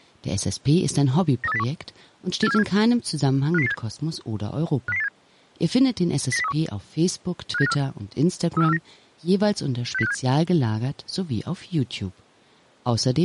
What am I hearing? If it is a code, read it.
Five-tone selective call (EEA), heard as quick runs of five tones, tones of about 40 ms, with speech in German. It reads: 93801 84747 50087 50087 09031 57954 34349 60657